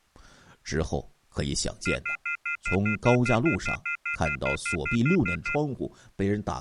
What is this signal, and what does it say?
Telephone call progress tone (North American plan), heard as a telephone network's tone, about 1400, 2050, 2450, 2600 Hz, 0.1 s on and 0.1 s off, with speech in Chinese. Off-hook warning tone.